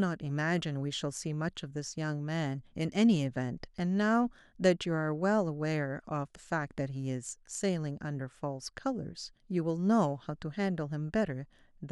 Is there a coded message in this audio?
No, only speech in English.